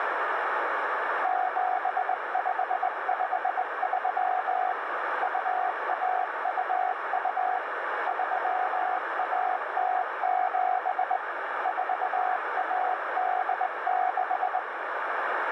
Morse code (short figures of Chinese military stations), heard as a keyed tone, hand-sent with a straight key, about 20 wpm, 740 Hz, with radio static and a narrow filter. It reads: 7553 2122 3107 4186